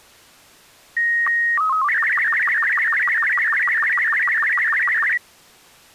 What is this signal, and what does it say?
SSTV (slow-scan television), Robot 36, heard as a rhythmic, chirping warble.